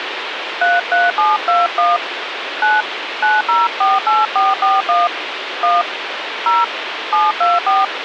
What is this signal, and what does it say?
DTMF, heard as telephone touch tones, dialled by hand, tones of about 190 ms, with phone line noise. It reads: 33721 9 9048441 1 0 724